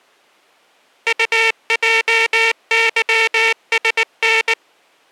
Morse code, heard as a buzzer, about 19 wpm. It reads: UJYSN